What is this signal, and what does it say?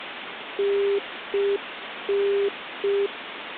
Telephone call progress tone (UK plan), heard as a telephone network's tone, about 400 Hz, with phone line noise. Congestion tone.